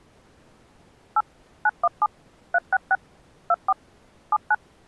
DTMF, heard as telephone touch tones, dialled by machine, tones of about 40 ms. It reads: 8 917 366 24 79